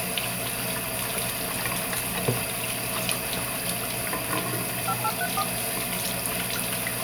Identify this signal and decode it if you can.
DTMF, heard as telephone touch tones, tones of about 60 ms, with the noise of a restroom. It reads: 5834